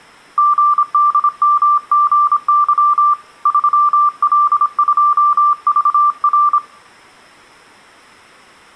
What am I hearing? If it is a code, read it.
Morse code, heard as a keyed tone, hand-sent with a paddle, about 26 wpm, 1180 Hz, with room echo. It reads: GDMGY 3L2VR